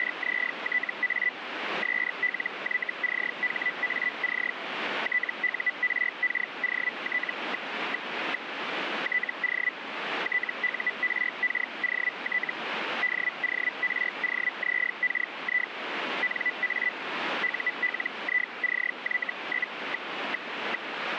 Hellschreiber (Feld-Hell, 122.5 baud), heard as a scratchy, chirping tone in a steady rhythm, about 2000 Hz, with radio static. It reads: … SLYCHAC TURKOT... TO TURKOT DOROZKI NA ULICY?...